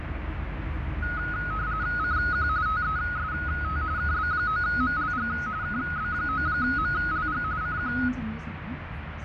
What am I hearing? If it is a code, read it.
RTTY (45.45 baud, 170 Hz shift), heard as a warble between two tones, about 1360 Hz centre, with radio static and the noise inside a bus. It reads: CQ TEST KB9MLG KB9MLG CQ